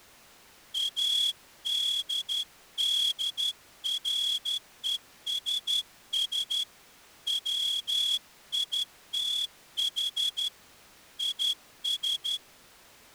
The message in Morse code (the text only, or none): ADDRESS WITH IS